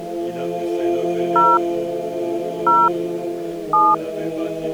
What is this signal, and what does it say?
DTMF, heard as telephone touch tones, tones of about 220 ms. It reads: 0 0 7